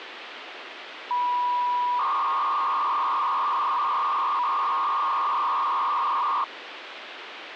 300-baud modem data (V.21 tones), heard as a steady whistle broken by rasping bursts, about 300 baud, 200 Hz shift, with phone line noise.